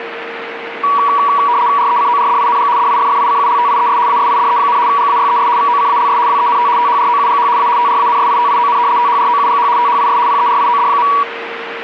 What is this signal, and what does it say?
RTTY (75 baud, 170 Hz shift), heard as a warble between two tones, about 1050 Hz centre, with radio static and a steady whistle near 460 Hz. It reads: RECORDING DIFFICULTIES ASIDE, GAYES VOCALS WENT THROUGH A TRANSITION THROUGH THIS PERIOD.